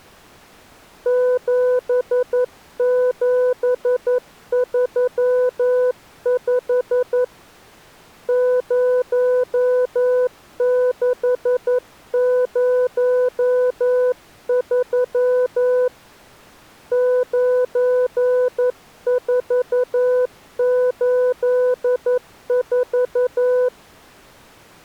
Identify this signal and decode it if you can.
Morse code, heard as a keyed tone, hand-sent with a paddle, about 11 wpm, 500 Hz. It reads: 7735 0603 9484